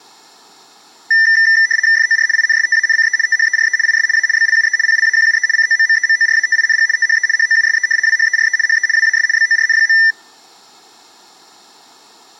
RTTY (75 baud, 170 Hz shift), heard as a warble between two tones, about 1900 Hz centre. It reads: FOR INSTANCE THERE IS A BLUE PLAQUE COMMEMORATING THE HOUSE WHERE HE WAS BORN.